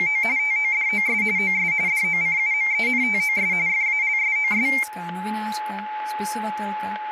RTTY (45.45 baud, 170 Hz shift), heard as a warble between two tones, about 2200 Hz centre, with static crashes and a steady whistle near 850 Hz. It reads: … TODOS OS DOCUMENTOS FALSOS